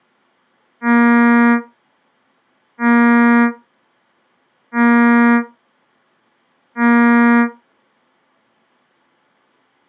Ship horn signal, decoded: 4 short

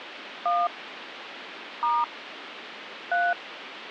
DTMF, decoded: 1 * 3

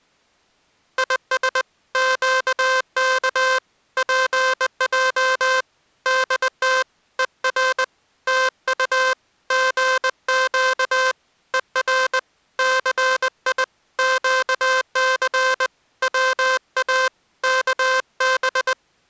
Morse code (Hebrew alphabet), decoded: יש קך פע דת ור תט גק ור סי קס צא כב

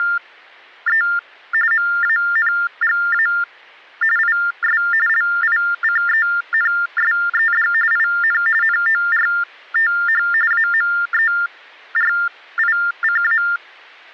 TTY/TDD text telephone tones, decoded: … MANGA IS LICENSED IN NORTH AMERICA

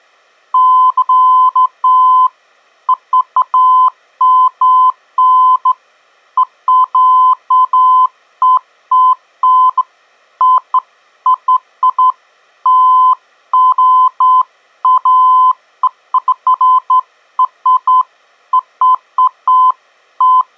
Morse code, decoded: none

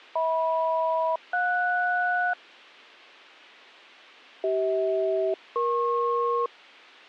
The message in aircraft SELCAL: HM-JS CH-EP

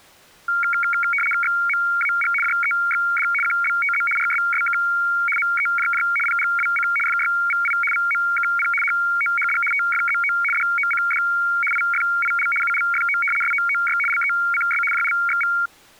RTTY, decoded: XMAG JEXD QBTZ RSSK MEJJ PGWC FYVI VMKP HOHD TFZO DOCD IFIL ULFO SOOY LECS JLXV

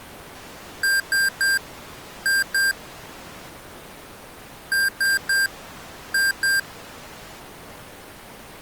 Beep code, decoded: 3-2

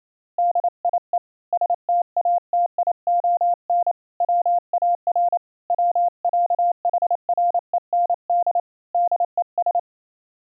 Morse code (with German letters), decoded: DIE STATION WAR WÄHREND DES

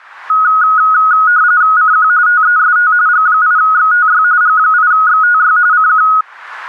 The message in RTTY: CQ TEST G8XTY G8XTY CQ

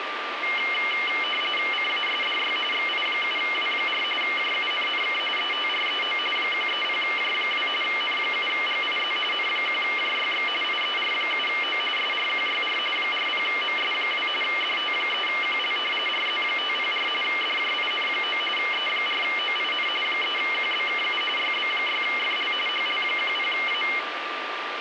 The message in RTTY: CASDY XI7W4 JUNNK ETREO 130J2 N7GIZ N1JYX IER7O SRQYR 40MS2 DT3QL RZ504 DJIN9 E4OIN 3QBKU YB6FL HL10A

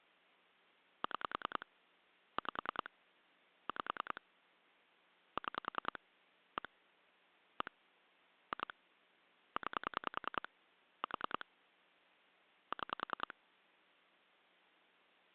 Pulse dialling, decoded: 6 5 5 6 1 1 2 9 4 6

